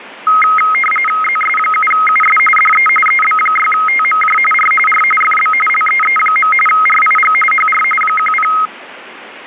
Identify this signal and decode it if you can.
RTTY (45.45 baud, 850 Hz shift), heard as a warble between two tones, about 1700 Hz centre, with radio static. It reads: ZS7US DE EB6TMJ R R FB LEE. RIG HR 10